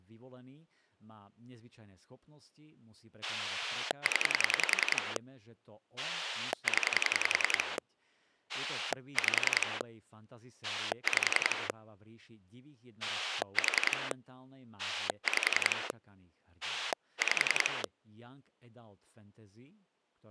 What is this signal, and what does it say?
Pulse dialling, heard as a rotary dial, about 10 pulses a second, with speech in Slovak. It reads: 0 0 5 5 4 5 5